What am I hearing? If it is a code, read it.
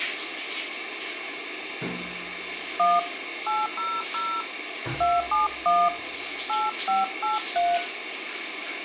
DTMF, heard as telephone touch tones, dialled by hand, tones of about 220 ms, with radio hiss and the noise of a restroom. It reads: 1 800 271 8583